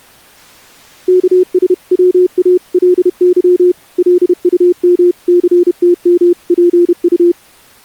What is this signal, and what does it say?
Morse code (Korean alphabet), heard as a keyed tone, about 31 wpm, 360 Hz. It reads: 여보게 김첨지